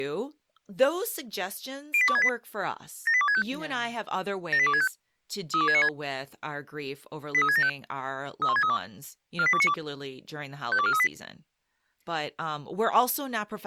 Five-tone selective call (ZVEI), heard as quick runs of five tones, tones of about 70 ms, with speech in English. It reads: 08268 78265 78265 32696 83675 31632 48292 52438